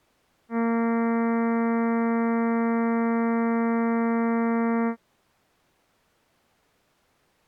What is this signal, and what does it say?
Ship horn signal, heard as a ship's horn, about 230 Hz. 1 long. At sea: a vessel nearing a blind bend, or under power and making way in fog.